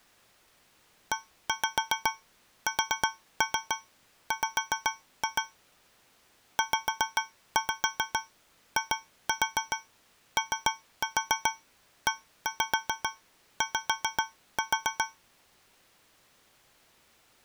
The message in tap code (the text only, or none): ESW ZIOEY